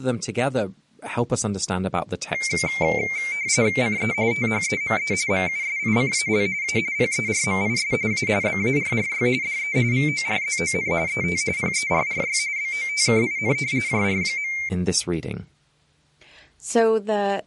RTTY (45.45 baud, 170 Hz shift), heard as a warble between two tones, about 2200 Hz centre, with speech in English. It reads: CE THEME MUSICAL A PERMIS A BARRY DE VORZON ET PERRY BOTKIN JR.